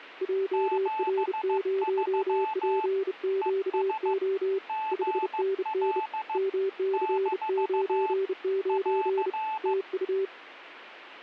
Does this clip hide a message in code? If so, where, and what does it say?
Yes: Morse code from 0.2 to 10.3 s, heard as two keyed tones. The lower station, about 31 wpm, 390 Hz: JR0PQO 5NN MC99 TU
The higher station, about 15 wpm, 870 Hz: 73 ES GL - <AR>